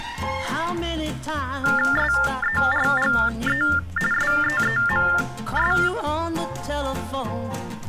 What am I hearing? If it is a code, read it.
TTY/TDD text telephone tones (45.45 baud Baudot), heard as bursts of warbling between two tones, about 400 Hz shift, 1600 Hz centre. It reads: SERGE SEEMS